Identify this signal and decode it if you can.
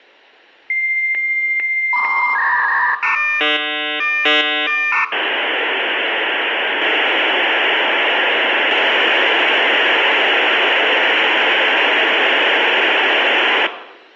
Dial-up modem handshake (V.34 or later), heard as a whistle, warbles, then hiss, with room echo.